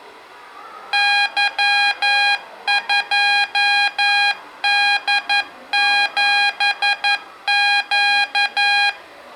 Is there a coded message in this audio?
Yes: Morse code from 0.9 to 9.0 s, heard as electronic beeps, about 11 wpm, 810 Hz, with room echo and the noise of a crowd indoors. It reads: Y2D7Q